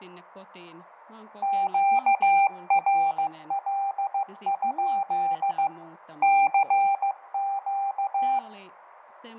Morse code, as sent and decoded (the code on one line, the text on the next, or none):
--.- .-. .-.. ..--.. / -.-. --.-
QRL? CQ